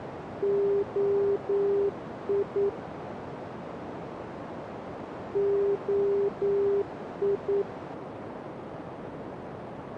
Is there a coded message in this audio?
Yes: Morse code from 0.4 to 7.7 s, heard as a keyed tone, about 9 wpm, 400 Hz, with radio static and a narrow filter. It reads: OI OI